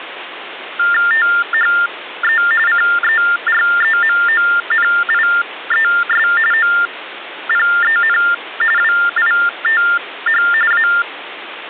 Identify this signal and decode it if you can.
TTY/TDD text telephone tones (45.45 baud Baudot), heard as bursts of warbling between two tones, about 400 Hz shift, 1600 Hz centre, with phone line noise. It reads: THE CEREMONIES OPEN WITH A